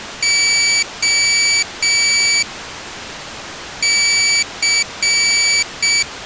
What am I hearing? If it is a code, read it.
Morse code (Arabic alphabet), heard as a high beeper, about 6 wpm, 2300 Hz. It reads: خ ث